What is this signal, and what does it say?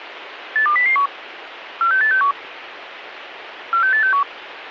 Five-tone selective call (CCIR), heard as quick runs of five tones, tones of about 100 ms, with radio hiss. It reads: 82001 46861 46861